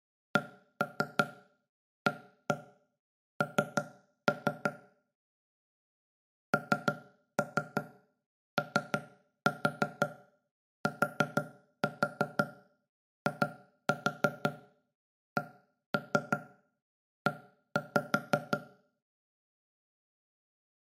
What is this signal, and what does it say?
Tap code, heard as knocks on wood, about 6 knocks a second, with room echo. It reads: CAN NOTICE